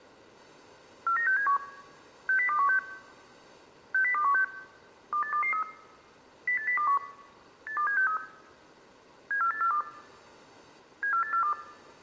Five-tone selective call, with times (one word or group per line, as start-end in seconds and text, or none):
1.1-1.6 49671
2.3-2.8 60216
3.9-4.4 60216
5.1-5.6 28223
6.5-7.0 08021
7.7-8.2 82763
9.3-9.8 74842
11.0-11.5 74842